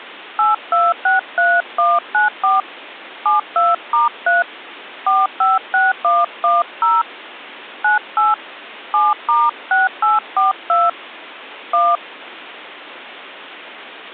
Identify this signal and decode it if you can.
DTMF, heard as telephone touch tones, dialled by hand, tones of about 180 ms. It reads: 8263194 72*3 456110 98 7*6842 1